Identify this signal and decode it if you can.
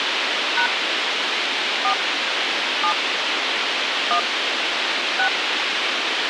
DTMF, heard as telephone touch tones, dialled by hand, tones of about 90 ms, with radio hiss. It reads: # 4 7 1 6